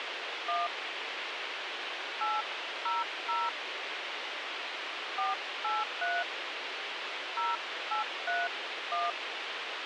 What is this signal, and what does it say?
DTMF, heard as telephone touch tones, dialled by hand, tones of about 150 ms, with radio hiss and a squelch burst at the end. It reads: 1 800 483 0831